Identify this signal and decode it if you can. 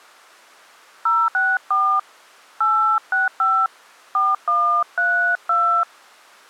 DTMF, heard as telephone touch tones, dialled by hand, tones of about 270 ms. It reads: 064 865 4132